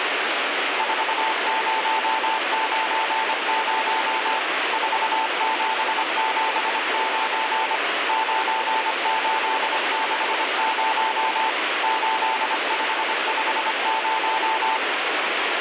Morse code, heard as a keyed tone, machine-sent, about 25 wpm, 880 Hz, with heavy radio static. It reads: 4090 4779 9860 8550